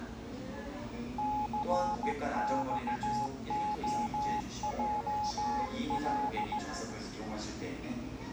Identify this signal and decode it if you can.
Morse code, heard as a keyed tone, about 16 wpm, 840 Hz, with the noise of a cafe. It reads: CXOJL